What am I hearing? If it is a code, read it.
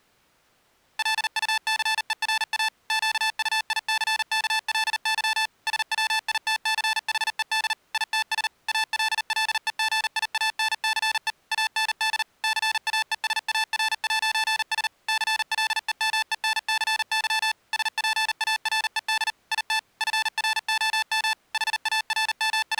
Morse code, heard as electronic beeps, machine-sent, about 39 wpm, 880 Hz. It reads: LUCERA QUICKLY SWITCHED ITS ALLEGIANCE AND CAESAR'S CLEMENCY SPARED IT FROM …